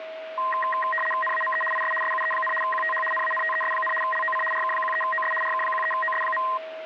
RTTY (75 baud, 850 Hz shift), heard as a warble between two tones, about 1460 Hz centre, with radio static and a steady whistle near 640 Hz. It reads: NAME IS SUE, QTH NANTES, LOC RK13OS RK13OS.